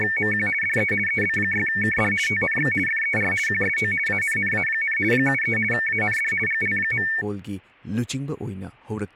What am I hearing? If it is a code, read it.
RTTY (50 baud, 450 Hz shift), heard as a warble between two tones, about 2000 Hz centre, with speech in Manipuri. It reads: … DE EB6KD TNX FER QSO ANNA, 73 AND GL.